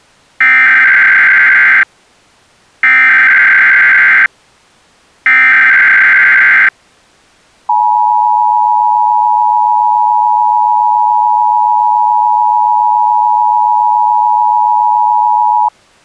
Emergency Alert System (SAME) tones (header bursts, then the 853 and 960 Hz attention tone), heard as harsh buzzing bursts, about 520.83 baud.